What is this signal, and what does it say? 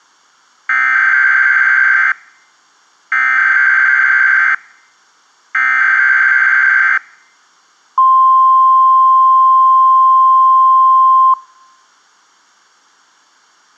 Emergency Alert System (SAME) tones (header bursts, then the 1050 Hz attention tone), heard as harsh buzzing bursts, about 520.83 baud.